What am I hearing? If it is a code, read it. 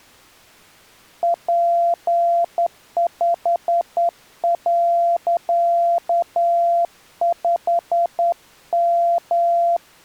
Morse code, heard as a keyed tone, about 10 wpm, 690 Hz. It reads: P5.5M